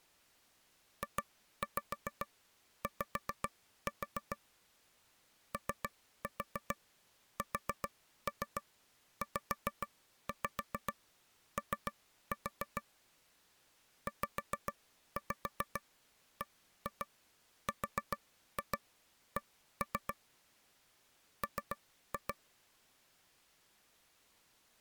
Tap code, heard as taps on a table, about 7 knocks a second. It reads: JY OSZO ZBRC M